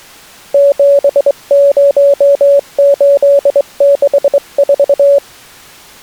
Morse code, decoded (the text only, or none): 70864